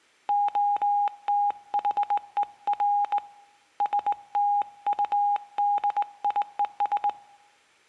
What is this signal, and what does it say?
Morse code, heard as a keyed tone, hand-sent with a straight key, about 19 wpm, 820 Hz, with room echo. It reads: OTHER STUDIES